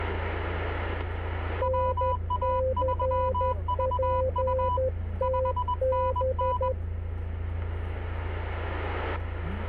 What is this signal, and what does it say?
Morse code, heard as two keyed tones, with the noise inside a car. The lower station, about 12 wpm, 520 Hz: NCPTB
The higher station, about 21 wpm, 990 Hz: WA3VU 5NN